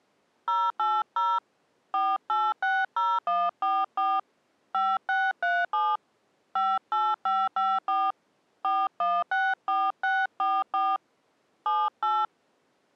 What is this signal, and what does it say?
DTMF, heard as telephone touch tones, dialled by hand, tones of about 220 ms. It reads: 080 4860144 5637 58554 4164644 78